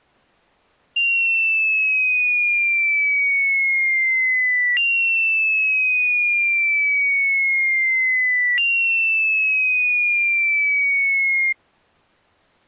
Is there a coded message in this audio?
No, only a tone that sweeps in pitch again and again.